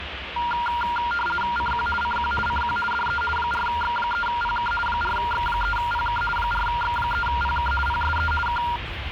RTTY (50 baud, 450 Hz shift), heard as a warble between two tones, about 1180 Hz centre, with radio static and the noise inside a car. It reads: CQ CQ CQ DE 4X3PK 4X3PK 4X3PK PSE K